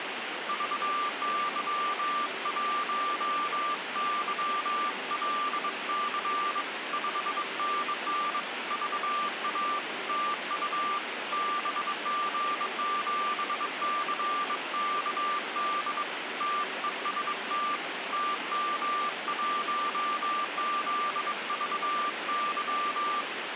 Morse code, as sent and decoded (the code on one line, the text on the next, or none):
...- -.-- .---- -.-- .-.. -.-. / ..... -. -. / ...- .- / - ..- / -... --. --... -.-. -.- -.. / - . ... - / - -- .---- --.. ...- -.--
VY1YLC 5NN VA TU BG7CKD TEST TM1ZVY